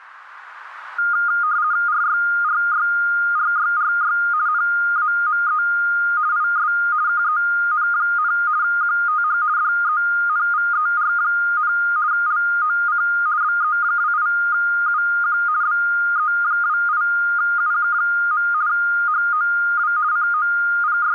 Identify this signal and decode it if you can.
RTTY (50 baud, 170 Hz shift), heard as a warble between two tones, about 1320 Hz centre. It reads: RYRYRYRY NAME IS KEN, QTH DENVER, LOC BE28UQ BE28UQ. HOW …